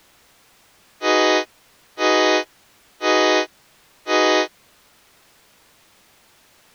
Train horn signal, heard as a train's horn. 4 short. On North American railways: a request for a signal to be given or repeated.